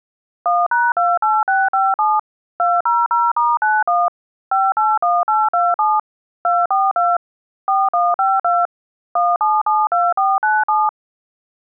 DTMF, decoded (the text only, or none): 1#28657 200*91 581827 242 4152 1772497